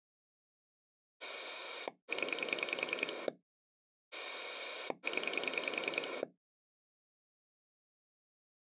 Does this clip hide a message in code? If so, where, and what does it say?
Yes: pulse dialling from 1.2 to 6.2 s, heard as a rotary dial, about 10 pulses a second. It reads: 0 0